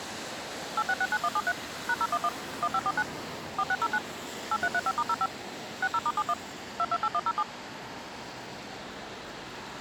DTMF, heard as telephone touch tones, dialled by machine, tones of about 50 ms, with street noise. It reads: 8669173 #011 1549 4609 8335*05 60*71 228107